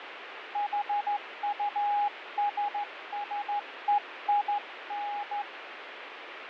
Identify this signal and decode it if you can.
Morse code, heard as a keyed tone, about 14 wpm, 820 Hz, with radio static and fading. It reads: HUSSEIN